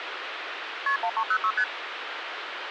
Multi-frequency trunk signalling (R1, as on North American trunks), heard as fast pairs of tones, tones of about 70 ms, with phone line noise. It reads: KP 1306 ST